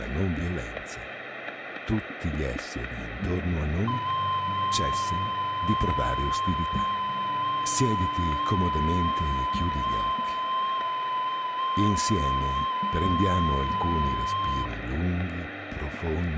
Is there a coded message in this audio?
Yes: FT8 (one signal) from 3.9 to 14.7 s, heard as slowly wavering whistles, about 6.25 baud, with room echo.